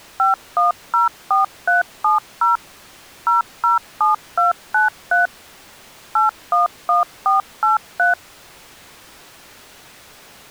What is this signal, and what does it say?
DTMF, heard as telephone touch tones, dialled by machine, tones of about 140 ms. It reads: 5104370 007293 811483